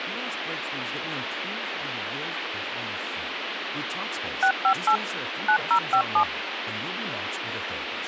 DTMF, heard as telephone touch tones, dialled by machine, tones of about 80 ms, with phone line noise and speech in Spanish. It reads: 658 9057